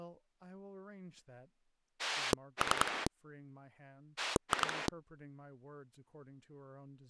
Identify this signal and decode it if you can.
Pulse dialling, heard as a rotary dial, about 10 pulses a second, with speech in English. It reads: 3 2